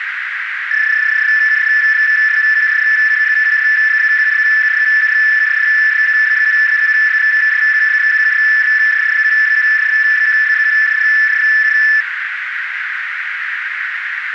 PSK31 (31.25 baud), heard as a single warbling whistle, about 1750 Hz, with radio static and a narrow filter.